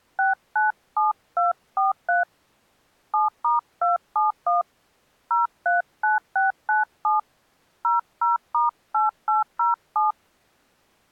DTMF, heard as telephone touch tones, dialled by hand, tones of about 150 ms. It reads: 697243 7*271 039697 00*8807